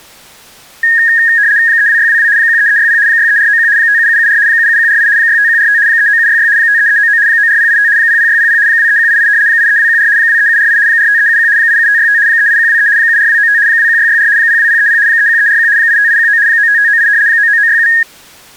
RTTY (75 baud, 170 Hz shift), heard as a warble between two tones, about 1750 Hz centre. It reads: 32622 13360 63491 57774 77148 65145 39766 53399 94085 00600 23188 83214 23748 45371 87565 38123 74295 21664 02030 31341 85819 95598 99967